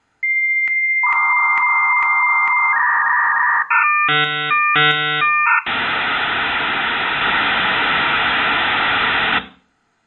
Dial-up modem handshake (V.34 or later), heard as a whistle, warbles, then hiss, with room echo.